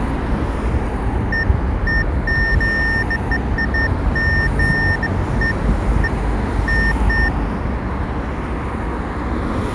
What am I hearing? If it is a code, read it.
Beeps of irregular length, with street noise. There is no code.